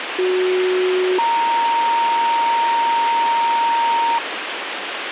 Two-tone page, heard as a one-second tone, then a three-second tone, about 370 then 930 Hz, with radio hiss.